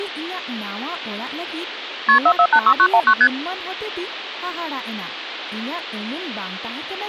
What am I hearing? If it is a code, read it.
Multi-frequency trunk signalling (R1, as on North American trunks), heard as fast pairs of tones, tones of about 70 ms, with speech in Santali. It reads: KP 4486919 ST